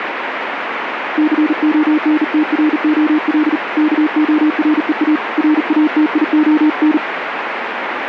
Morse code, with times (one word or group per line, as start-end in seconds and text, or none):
1.2-3.6 CONTROL
3.8-5.2 KOREA
5.4-7.0 RATION